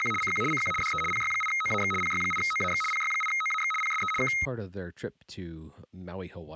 RTTY (75 baud, 850 Hz shift), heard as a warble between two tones, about 1700 Hz centre, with speech in English. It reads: … CQ CQ DE PY8OAX PY8OAX PY8OAX PSE K